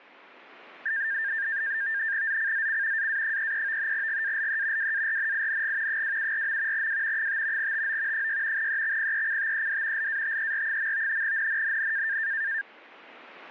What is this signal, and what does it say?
NAVTEX (SITOR-B), 100 baud, 170 Hz shift, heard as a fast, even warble, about 1700 Hz centre. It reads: ZCZC AA33 GALE WARNING 274. W 5 TO 6 EXPECTED LATER. NNNN